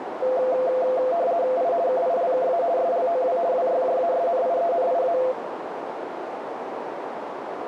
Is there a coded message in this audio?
Yes: RTTY (50 baud, 170 Hz shift) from 0.2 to 5.3 s, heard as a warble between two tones, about 600 Hz centre, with radio static and a narrow filter. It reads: I KILKA SLOW WYJASNIENIA